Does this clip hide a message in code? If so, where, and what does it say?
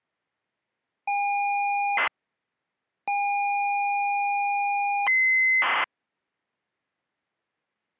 Yes: ZX Spectrum tape loading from 1.1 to 5.8 s, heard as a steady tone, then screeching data.